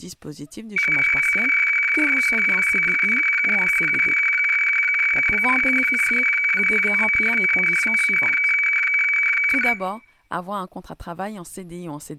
Weather fax (radiofax), 120 lines a minute, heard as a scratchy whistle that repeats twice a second, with room echo and speech in French.